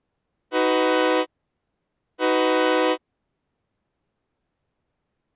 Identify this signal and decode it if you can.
Train horn signal, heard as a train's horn. 2 short. On North American railways: a signal is acknowledged.